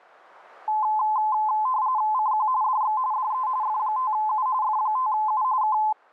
RTTY (45.45 baud, 170 Hz shift), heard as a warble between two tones, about 940 Hz centre. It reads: CQ DX DE F5U F5U K